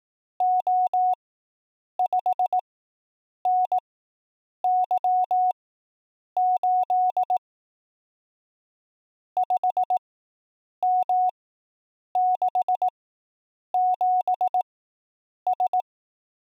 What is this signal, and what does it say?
Morse code, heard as a keyed tone, machine-sent, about 18 wpm, spaced as for 8 wpm, 740 Hz. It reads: O5NY8 5M67S